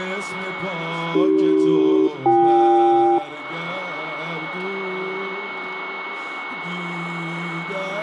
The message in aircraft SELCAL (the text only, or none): AC-BK